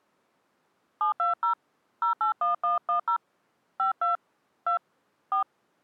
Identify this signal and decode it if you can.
DTMF, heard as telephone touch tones, dialled by hand, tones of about 120 ms. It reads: 720 081110 52 2 4